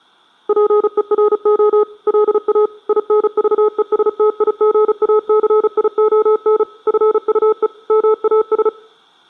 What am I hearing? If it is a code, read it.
Morse code, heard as a keyed tone, machine-sent, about 35 wpm, 430 Hz. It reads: PERO LA INVESTIGACION FUE MAS